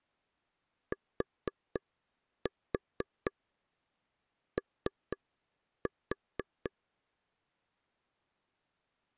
Tap code, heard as taps on a table, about 4 knocks a second. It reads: TO